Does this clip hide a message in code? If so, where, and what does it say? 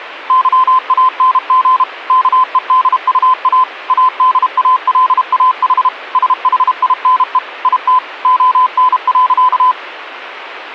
Yes: Morse code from 0.2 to 9.8 s, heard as a keyed tone, machine-sent, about 32 wpm, 1020 Hz. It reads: YANG KEDUA ADALAH SHINE IT ON.